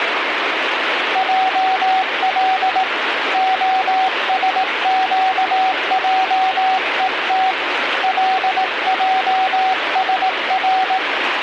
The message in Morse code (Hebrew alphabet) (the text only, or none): על השקעות לעשר